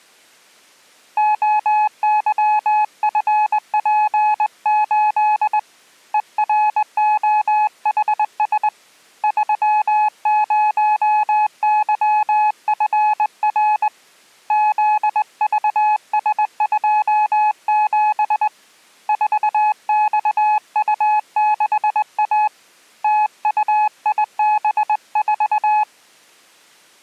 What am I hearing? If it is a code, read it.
Morse code, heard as a keyed tone, hand-sent with a straight key, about 20 wpm, 850 Hz. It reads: OYFP8 EROHS 30YFR ZVS27 4XU6A TUIB4